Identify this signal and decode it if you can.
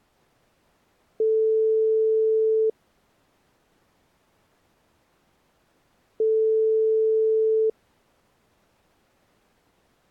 Telephone call progress tone (single-tone plan, as in most of Europe), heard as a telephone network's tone, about 440 Hz, 1.5 s on and 3.5 s off. Ringback tone.